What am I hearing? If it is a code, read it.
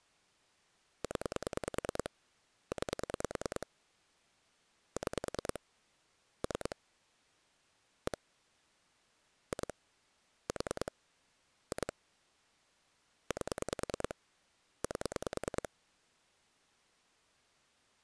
Pulse dialling, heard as clicks on a phone line, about 10 pulses a second. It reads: 0 9 6 3 1 2 4 2 8 8